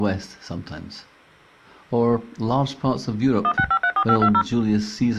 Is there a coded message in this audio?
Yes: DTMF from 3.4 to 4.4 s, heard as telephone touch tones, dialled by machine, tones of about 70 ms. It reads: 16534520